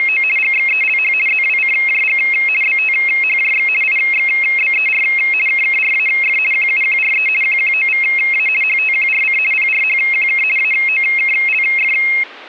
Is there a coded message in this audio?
Yes: RTTY (50 baud, 450 Hz shift) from 0.0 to 12.2 s, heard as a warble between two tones, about 2350 Hz centre. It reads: … GXELH ZWCJG BTHJX IXBER KKRAF QUQRE QQOVA HTQRC PRHQK AOKLF